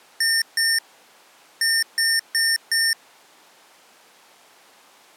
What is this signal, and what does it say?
Beep code, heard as beeps from a small speaker, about 1800 Hz. 2-4.